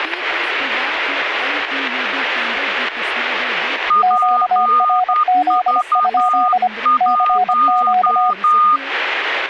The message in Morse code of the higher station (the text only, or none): PV1